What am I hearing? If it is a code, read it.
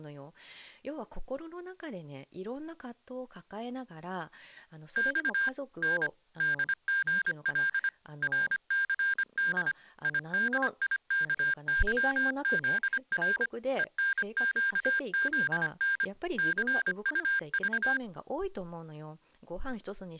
Morse code, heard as electronic beeps, machine-sent, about 25 wpm, 1600 Hz, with speech in Japanese. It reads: X N DGL RCD IDIKYZR ENQZN CUV